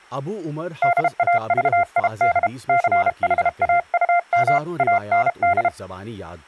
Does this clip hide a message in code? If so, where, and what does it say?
Yes: Morse code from 0.8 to 5.7 s, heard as a keyed tone, hand-sent with a paddle, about 32 wpm, 700 Hz, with speech in Urdu. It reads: DAVID CHAUM AND